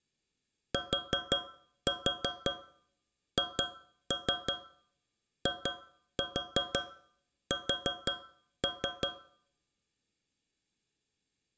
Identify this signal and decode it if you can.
Tap code, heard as taps on a metal pipe, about 5 knocks a second, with room echo. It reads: THIS